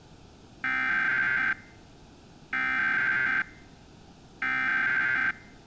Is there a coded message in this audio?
Yes: Emergency Alert System (SAME) tones (header bursts) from 0.6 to 5.3 s, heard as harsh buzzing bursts, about 520.83 baud.